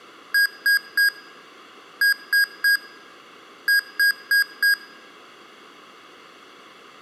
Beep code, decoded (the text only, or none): 3-3-4